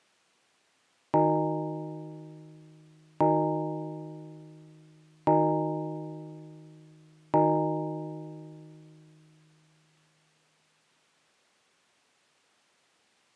Clock strike, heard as a bell. 4. Four o'clock.